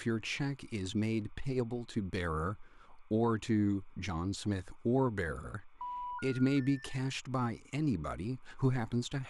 Telephone call progress tone (North American plan), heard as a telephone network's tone, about 980, 1430, 1800 Hz, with speech in English. Special information tone.